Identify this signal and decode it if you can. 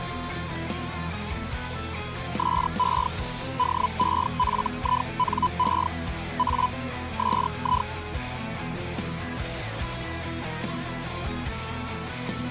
Hellschreiber (Feld-Hell, 122.5 baud), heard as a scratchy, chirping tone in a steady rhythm, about 1000 Hz. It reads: SE DEFINE A SI